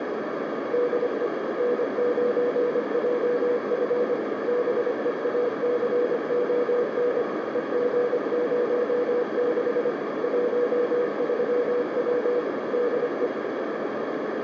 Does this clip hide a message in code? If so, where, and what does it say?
Yes: Morse code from 0.7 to 13.3 s, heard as a keyed tone, machine-sent, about 25 wpm, 490 Hz, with heavy radio static and a narrow filter. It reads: DE N9JF BEACON EG06 13W DE